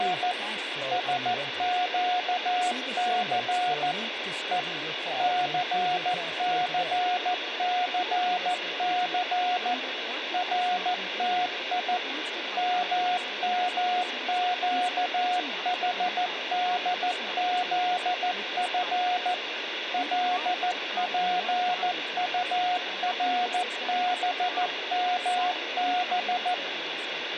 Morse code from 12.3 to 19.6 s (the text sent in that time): MMQHDZF